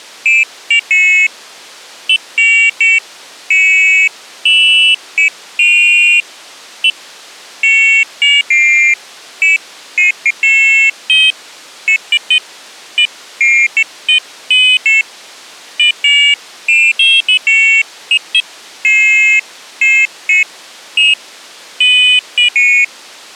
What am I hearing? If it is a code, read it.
Pairs of high tones at irregular times. There is no code.